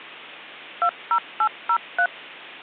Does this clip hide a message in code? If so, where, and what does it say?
Yes: DTMF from 0.8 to 2.1 s, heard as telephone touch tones, dialled by machine, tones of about 70 ms, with hum. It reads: 20803